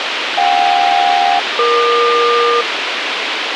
Aircraft SELCAL, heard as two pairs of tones, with radio hiss. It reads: JK-EQ